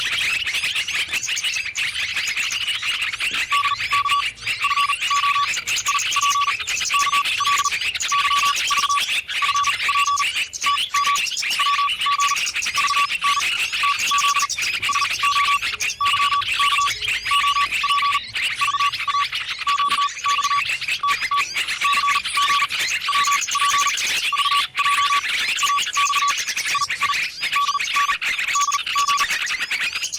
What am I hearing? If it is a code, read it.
Morse code, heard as a keyed tone, machine-sent, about 39 wpm, spaced as for 28 wpm, 1140 Hz. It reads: DK FO IP KL YV FP TM WG VN TZ SO YK OP VA QX TT CG WP VJ AX II DN DG